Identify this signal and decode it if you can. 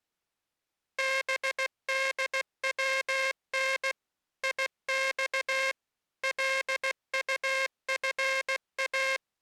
Morse code (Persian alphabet), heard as a buzzer, machine-sent, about 16 wpm. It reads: بدون یخ لطفا